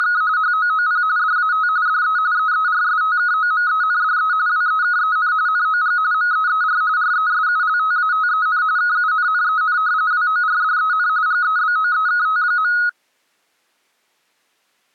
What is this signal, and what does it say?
RTTY (45.45 baud, 170 Hz shift), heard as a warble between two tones, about 1360 Hz centre. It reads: … HOOP DAT DE EERSTKOMENDE WEKEN NOG MEER RESULTATEN KUNNEN WORDEN GEBOEKT.